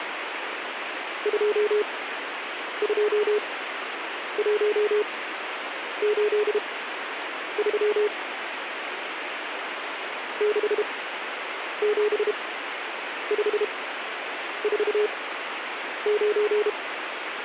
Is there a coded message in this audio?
Yes: Morse code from 1.2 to 16.8 s, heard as a keyed tone, machine-sent, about 32 wpm, spaced as for 8 wpm, 420 Hz, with radio static. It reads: 22183 67549